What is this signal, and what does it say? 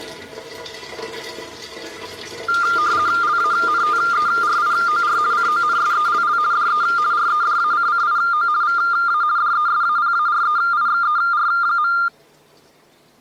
RTTY (50 baud, 170 Hz shift), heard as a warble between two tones, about 1300 Hz centre. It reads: LANTERIOR CONSELL DE REDACCIO VA DESAPAREIXER.